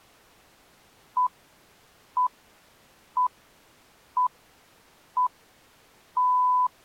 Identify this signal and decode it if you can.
Radio time signal (six pips, as the Greenwich Time Signal), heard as pips.